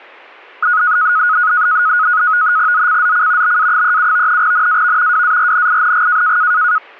NAVTEX (SITOR-B), 100 baud, 170 Hz shift, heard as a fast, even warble, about 1360 Hz centre. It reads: ZCZC BA37 NAV WARNING